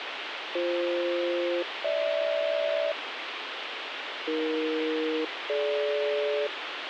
Aircraft SELCAL, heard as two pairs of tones, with radio hiss. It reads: BF-GH AE-DG